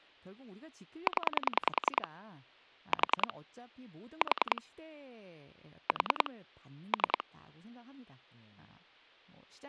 Pulse dialling, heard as clicks on a phone line, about 10 pulses a second, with speech in Korean. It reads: 0 4 4 4 3